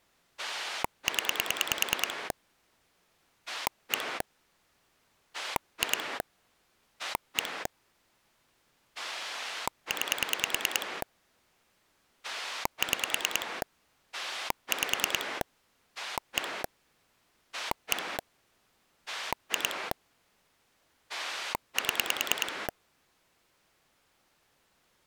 Pulse dialling, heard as a rotary dial, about 9 pulses a second. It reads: 0 1 2 1 9 6 5 1 1 2 7